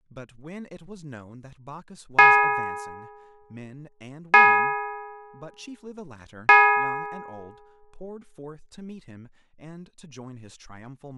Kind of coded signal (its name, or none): clock strike